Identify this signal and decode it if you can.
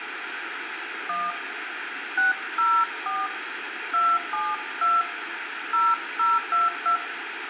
DTMF, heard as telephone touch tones, dialled by hand, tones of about 180 ms, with phone line noise and room echo. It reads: 1 604 272 0022